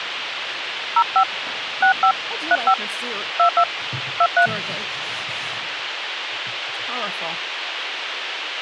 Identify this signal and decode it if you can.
DTMF, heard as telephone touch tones, dialled by hand, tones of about 70 ms, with radio hiss. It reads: 05 65 35 22 23